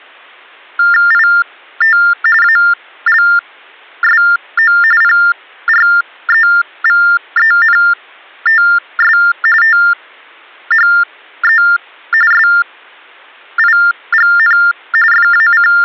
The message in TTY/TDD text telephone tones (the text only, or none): IT ALSO PREVENTS THE SIGN …